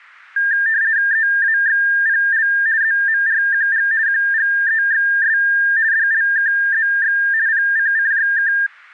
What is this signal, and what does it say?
RTTY (50 baud, 170 Hz shift), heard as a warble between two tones, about 1700 Hz centre. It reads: EAXPL ZMRQG QGEXS DLKZX PCCJK